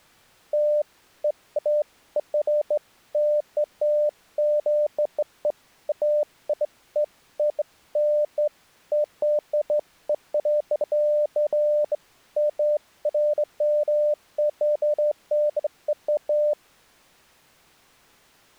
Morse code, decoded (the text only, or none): none